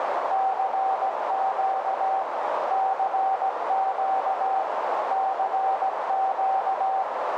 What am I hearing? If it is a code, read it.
Morse code, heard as a keyed tone, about 17 wpm, 770 Hz, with heavy radio static and a narrow filter. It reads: CQ CQ CQ